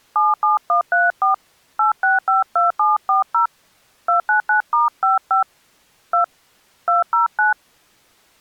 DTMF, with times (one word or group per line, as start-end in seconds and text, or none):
0.2-1.3 77134
1.8-3.5 8652740
4.1-5.4 299*55
6.1-6.2 2
6.9-7.5 209